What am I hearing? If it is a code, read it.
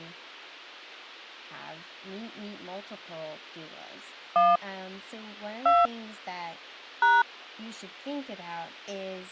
DTMF, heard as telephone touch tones, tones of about 200 ms, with speech in English. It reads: 1 2 #